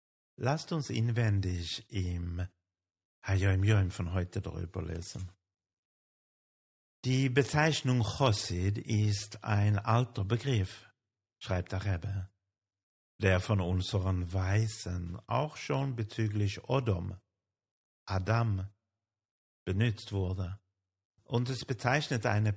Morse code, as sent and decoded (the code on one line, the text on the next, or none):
none